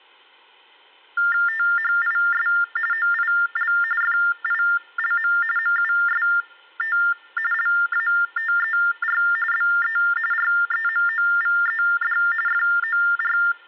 TTY/TDD text telephone tones (45.45 baud Baudot), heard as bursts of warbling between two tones, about 400 Hz shift, 1600 Hz centre. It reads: THIS OIL FILM MUST LATER BE REMOVED FOR